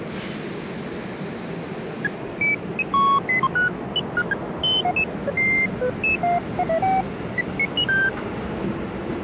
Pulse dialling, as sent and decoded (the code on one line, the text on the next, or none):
none